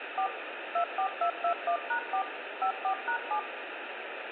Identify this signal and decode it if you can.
DTMF, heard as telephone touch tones, dialled by machine, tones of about 90 ms, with phone line noise. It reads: 4 24221#4 54#7